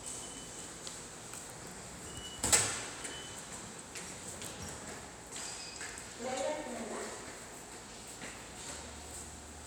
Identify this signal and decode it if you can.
The noise of a subway station. There is no code.